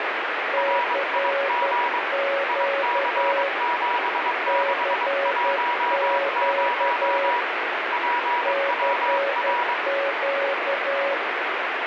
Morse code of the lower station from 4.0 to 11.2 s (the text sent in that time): CQ CQ